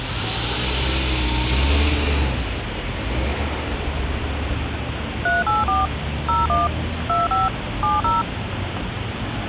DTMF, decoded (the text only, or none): 384 01 25 70